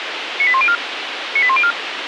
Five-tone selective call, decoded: 98104 98104

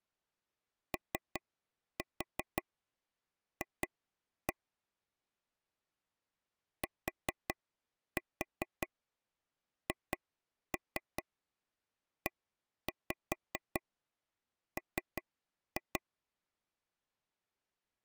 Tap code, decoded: OF THEM

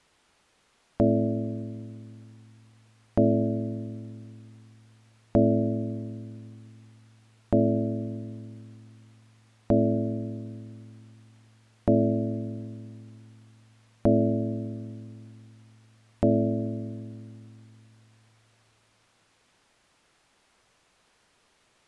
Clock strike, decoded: 8

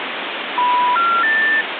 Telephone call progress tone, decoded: special information tone

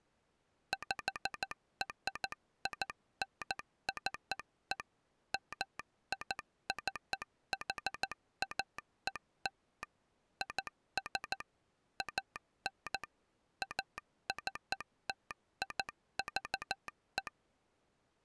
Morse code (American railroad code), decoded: PRINCE MICHAEL IS AN ACTIVE

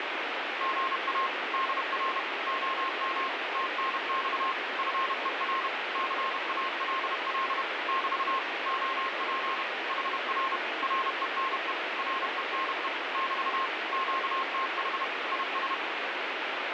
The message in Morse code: GA DR OM TNX FER CALL <BT> OP HR RENE RENE <BT> QTH IS

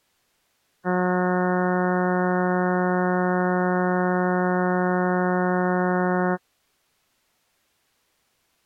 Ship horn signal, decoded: 1 long

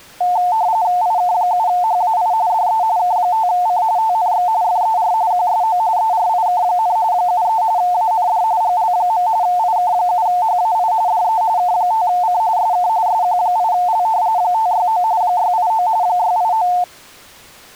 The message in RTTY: IK7HAI DE K5C TNX FER QSO ERIK, 73 AND GL. IK7HAI DE K5C SK SQ8L 569 689 689

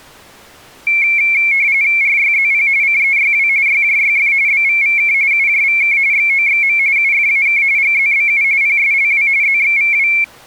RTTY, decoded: RYZP CEYW YJYF BVVK UJVK XOXM UFAK GZBU PSLW ZXVW

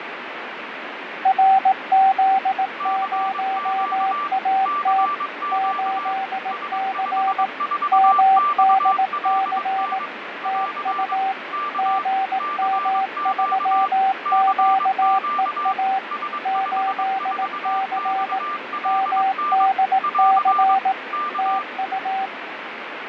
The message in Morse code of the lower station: RZ0AT 8C MDC TU GM3QEA 8C MDC TU

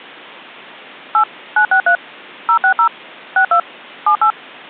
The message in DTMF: 8 963 060 62 78

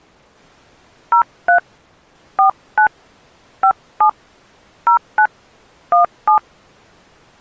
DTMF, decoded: 03 49 57 09 17

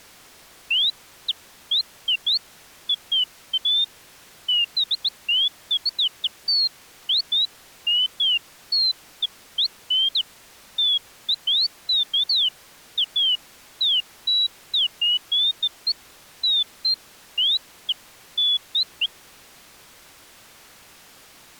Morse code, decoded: none

